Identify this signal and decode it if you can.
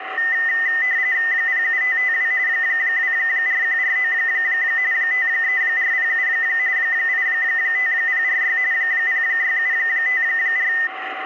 RTTY (45.45 baud, 170 Hz shift), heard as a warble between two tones, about 1900 Hz centre, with radio static and a steady whistle near 760 Hz. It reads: 07552 24149 53407 85046 06754